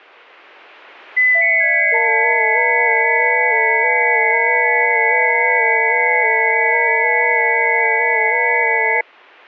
FT8 (several signals at once), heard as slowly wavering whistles, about 6.25 baud.